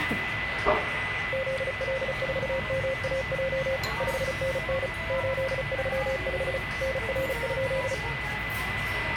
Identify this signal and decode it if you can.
Morse code, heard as a keyed tone, machine-sent, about 35 wpm, 530 Hz, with radio static, a steady whistle near 2000 Hz and the noise of a restaurant. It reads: ZL4MAJ 5NN 835 NR?